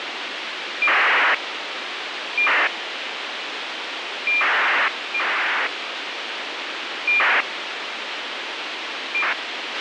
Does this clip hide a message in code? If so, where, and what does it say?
Yes: ACARS aircraft data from 0.8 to 9.3 s, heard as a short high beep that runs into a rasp, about 2400 baud, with radio hiss and a squelch burst at the end.